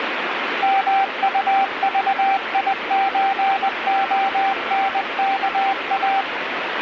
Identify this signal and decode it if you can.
Morse code (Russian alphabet), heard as a keyed tone, machine-sent, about 20 wpm, 780 Hz, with radio static and a weaker station near 1350 Hz. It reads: МУЖИЧОНКА